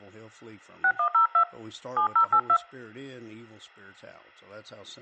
DTMF, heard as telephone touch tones, dialled by hand, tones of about 90 ms, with speech in English. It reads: 6102 7082